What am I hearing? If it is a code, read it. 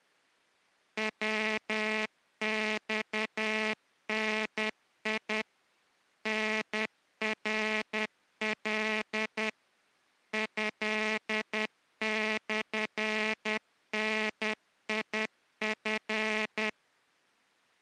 Morse code (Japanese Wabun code), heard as a buzzer, machine-sent, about 10 wpm. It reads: ヤマダ タナカ トモダチ